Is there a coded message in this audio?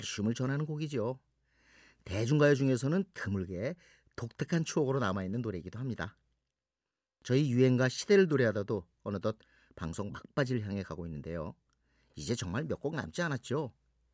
No, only speech in Korean.